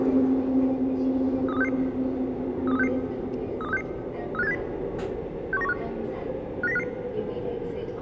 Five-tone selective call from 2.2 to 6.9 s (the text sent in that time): 32366 32366 35870 61915 59055